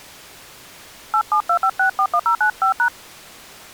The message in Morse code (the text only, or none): none